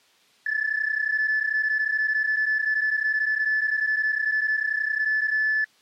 PSK31 (31.25 baud), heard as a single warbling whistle, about 1750 Hz.